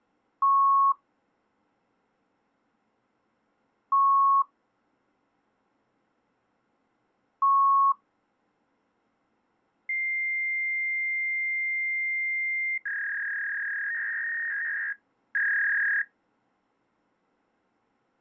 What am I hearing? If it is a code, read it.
Fax machine handshake, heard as beeps, a long tone and a warble.